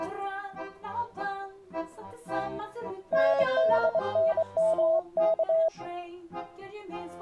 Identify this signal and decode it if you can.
Morse code (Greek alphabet), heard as a keyed tone, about 24 wpm, 650 Hz. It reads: ΝΔΝΜΚ